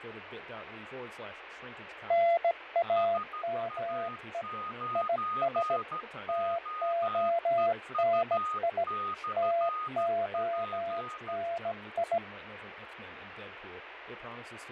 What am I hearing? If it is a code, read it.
Morse code, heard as two keyed tones, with radio static, fading and speech in English. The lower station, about 17 wpm, 680 Hz: NAME IS TONI TONI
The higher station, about 13 wpm, 1240 Hz: SA9OEU/P